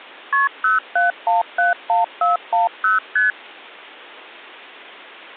Multi-frequency trunk signalling (R1, as on North American trunks), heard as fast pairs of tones, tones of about 150 ms. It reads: KP 07171410 ST